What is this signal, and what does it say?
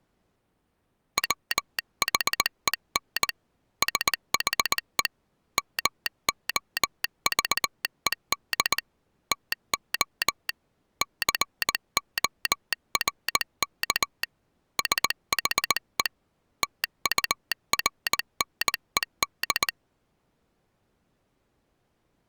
Morse code, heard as a telegraph sounder, hand-sent with a paddle, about 19 wpm. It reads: WHEN SHE MOVED TO CORK SHE TURNED